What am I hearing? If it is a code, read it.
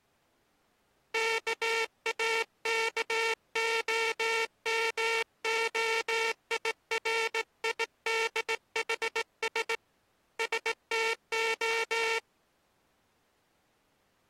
Morse code (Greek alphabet), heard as a buzzer, hand-sent with a straight key, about 18 wpm. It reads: ΚΑΚΟΜΟΙΡΙΔΗΣ ΣΤΟ